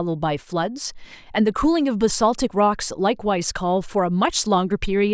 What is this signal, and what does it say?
Speech in English. There is no code.